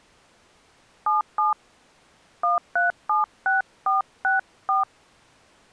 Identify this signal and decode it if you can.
DTMF, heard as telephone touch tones, dialled by hand, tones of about 150 ms. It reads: 77 1376464